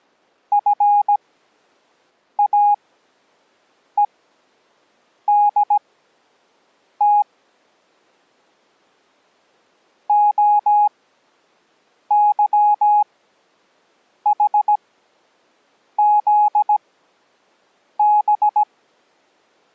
Morse code, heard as a keyed tone, machine-sent, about 17 wpm, spaced as for 6 wpm, 830 Hz. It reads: FAEDT OYHZB